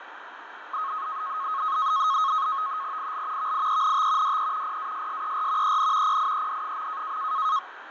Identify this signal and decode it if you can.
NAVTEX (SITOR-B), 100 baud, 170 Hz shift, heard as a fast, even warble, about 1180 Hz centre, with radio static and fading. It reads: IL VIENT DE PASSER EN PIED.